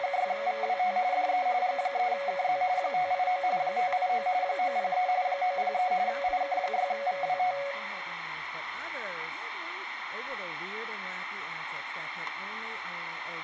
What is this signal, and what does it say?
RTTY (45.45 baud, 170 Hz shift), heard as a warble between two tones, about 650 Hz centre, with radio static. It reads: … DE G3KZ 589 589 903 903 IK6VWT